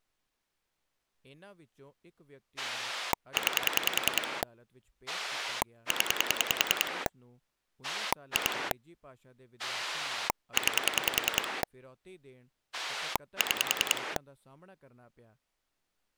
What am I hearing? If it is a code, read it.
Pulse dialling, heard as a rotary dial, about 10 pulses a second, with speech in Punjabi. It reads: 9 0 2 9 6